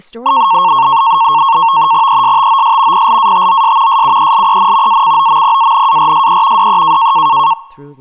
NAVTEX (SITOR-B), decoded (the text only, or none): ESTOS PLATOS SUELEN ACOMPANARSE DE